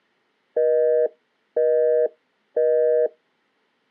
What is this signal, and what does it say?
Telephone call progress tone (North American plan), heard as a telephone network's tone, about 480, 620 Hz, 0.5 s on and 0.5 s off. Busy tone.